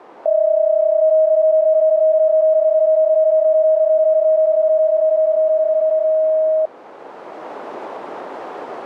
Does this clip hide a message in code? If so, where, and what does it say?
Yes: PSK31 (31.25 baud) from 0.3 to 6.7 s, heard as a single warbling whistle, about 630 Hz.